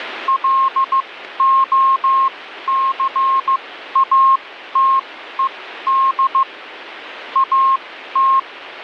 Morse code, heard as a keyed tone, machine-sent, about 15 wpm, spaced as for 12 wpm, 1070 Hz, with radio static. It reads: LOCATED AT